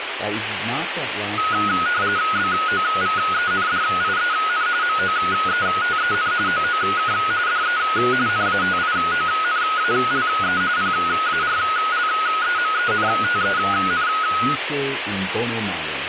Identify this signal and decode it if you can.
RTTY (45.45 baud, 170 Hz shift), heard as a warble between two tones, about 1360 Hz centre, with radio static and speech in English. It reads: BOVENDIEN MOETEN OOK DE NATIONALE PARLEMENTEN